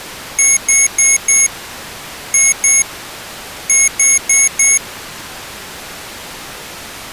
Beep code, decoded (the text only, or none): 4-2-4